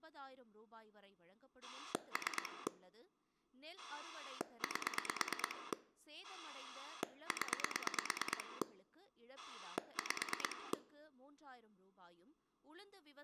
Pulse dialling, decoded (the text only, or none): 3 8 0 5